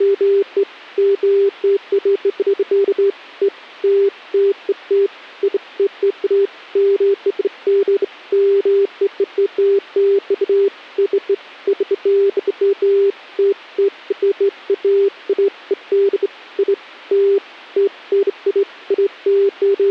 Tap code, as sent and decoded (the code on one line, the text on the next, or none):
none